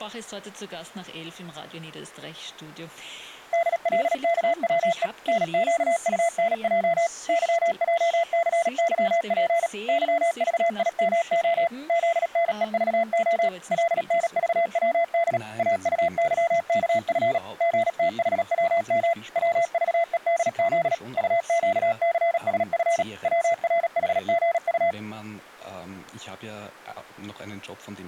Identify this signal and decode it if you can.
Morse code, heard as a keyed tone, machine-sent, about 37 wpm, 680 Hz. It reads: DLKWE NQUNJ YJCYP YVIMO ZNEVO LNVWD AUYKF GTHWM WVEDZ UQCSF WRHGU